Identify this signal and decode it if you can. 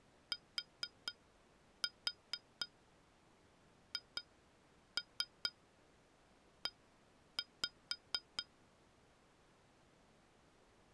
Tap code, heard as taps on glass, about 4 knocks a second. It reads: THE